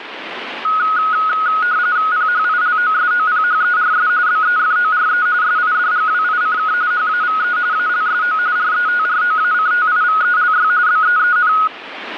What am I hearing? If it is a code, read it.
RTTY (45.45 baud, 170 Hz shift), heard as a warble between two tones, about 1360 Hz centre, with radio static and static crashes. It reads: PHILOSOPHERS BEFORE SIDGWICK HAVE ALSO RETROACTIVELY BEEN